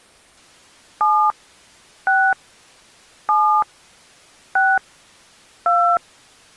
DTMF, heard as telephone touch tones, dialled by hand, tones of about 270 ms. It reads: 7 6 7 6 2